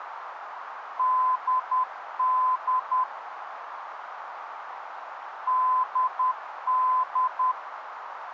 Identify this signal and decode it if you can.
Morse code, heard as a keyed tone, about 10 wpm, 1020 Hz, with radio static and a narrow filter. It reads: DD DD